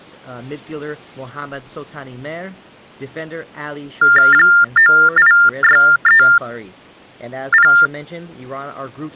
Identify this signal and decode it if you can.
TTY/TDD text telephone tones (45.45 baud Baudot), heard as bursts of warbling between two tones, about 400 Hz shift, 1600 Hz centre, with speech in English. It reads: 98630